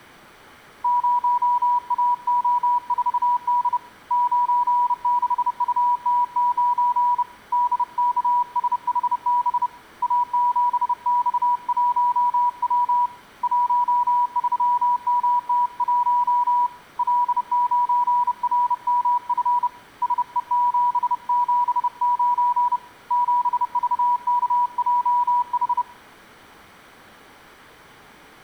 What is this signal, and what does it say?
Morse code, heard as a keyed tone, hand-sent with a bug key, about 30 wpm, 970 Hz. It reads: 0AO4D 96UT9 DKSHB A7X1W 13MT1 L9RMF SE779 7VKJH